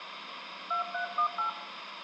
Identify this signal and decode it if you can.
DTMF, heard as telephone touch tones, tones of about 110 ms, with phone line noise and room echo. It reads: 2318